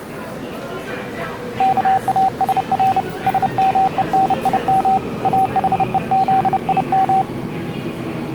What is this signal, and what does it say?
Morse code (Hebrew alphabet), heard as a keyed tone, hand-sent with a paddle, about 30 wpm, 770 Hz, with the noise of a subway station. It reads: כאשר שמונים אחוזים